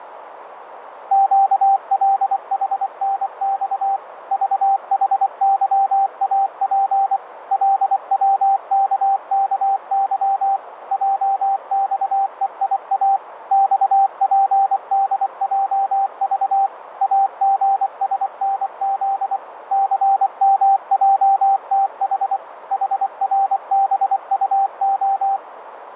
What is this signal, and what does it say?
Morse code, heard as a keyed tone, machine-sent, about 24 wpm, 780 Hz, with radio static and a narrow filter. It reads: QLHNX VHYAP LWKKY JXEIA XPDJV AGSNZ CMJTH HRBUO